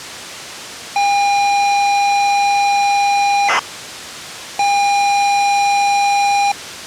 ZX Spectrum tape loading, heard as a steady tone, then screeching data.